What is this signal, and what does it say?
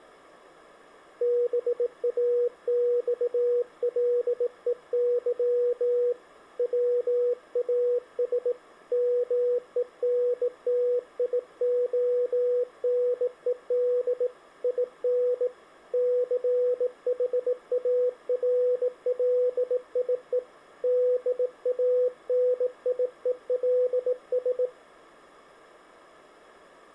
Morse code, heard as a keyed tone, hand-sent with a bug key, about 18 wpm, 490 Hz. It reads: BAXLEY WAS MENTIONED IN CHARLIE DANIELS